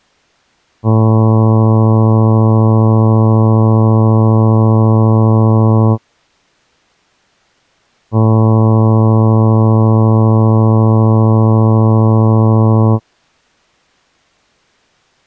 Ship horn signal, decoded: 2 long

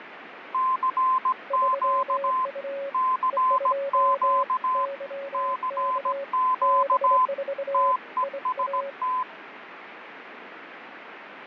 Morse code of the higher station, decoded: CQ CQ CQ TEST

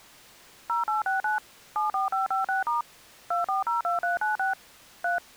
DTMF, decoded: 0869 74556* 2402396 3

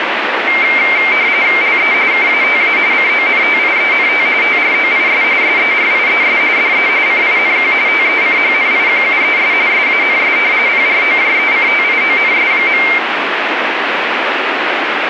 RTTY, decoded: LE KATA CONTIENT TROIS SERIES DE CINQ TECHNIQUES SANS PROJECTIONS.

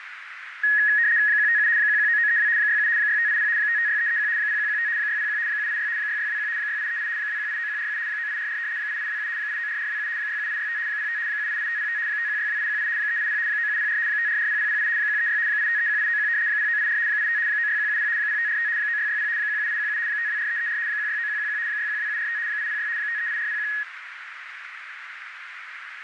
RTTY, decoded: 157 119932 67 6580 556331 0115 601 786 6621 6838 2189147 9844 8827 894427 67865 05 788505 5162818 380 9704 5440008 136 8531891 0984 85 96170 0545 9660 17817 524334 169111 612745 806 538401

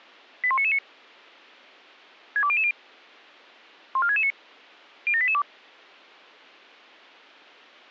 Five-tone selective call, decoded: 81999 62000 14669 07882

